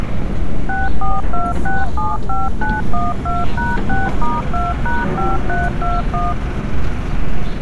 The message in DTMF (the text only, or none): 642675912#6*2#5321